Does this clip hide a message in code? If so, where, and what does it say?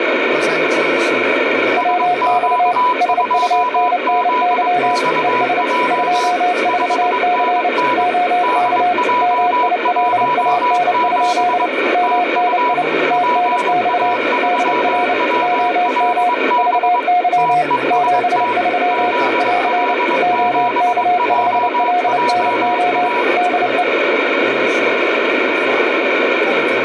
Yes: Morse code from 1.7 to 23.9 s, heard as two keyed tones, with radio static. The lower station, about 29 wpm, 720 Hz: WX SUNNY ES 24C OK MILAN? MNI TNX DR OM VY 73 <AR> OK5LNO DE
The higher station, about 22 wpm, 980 Hz: SQ2ZXJ 5NN DJ17 TU PA3WLB TEST ZL7JJA